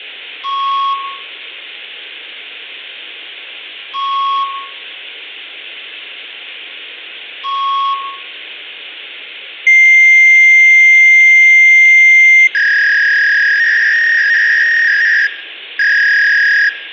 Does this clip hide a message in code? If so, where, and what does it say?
Yes: fax machine handshake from 0.4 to 16.7 s, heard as beeps, a long tone and a warble, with phone line noise and room echo.